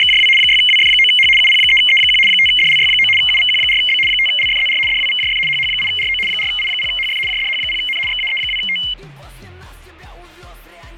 RTTY (75 baud, 850 Hz shift), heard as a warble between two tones, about 2550 Hz centre, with fading. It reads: … 6WF9H UP3E1 5DLY9 UVQ4B 5LFZR DWVJF HH8RO 4I0HF JDH0N XAE2T